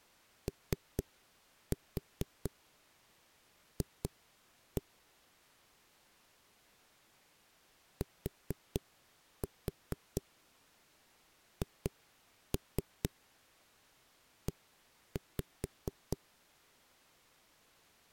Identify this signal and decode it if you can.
Tap code, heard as knocks on a wall, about 4 knocks a second. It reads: OF THE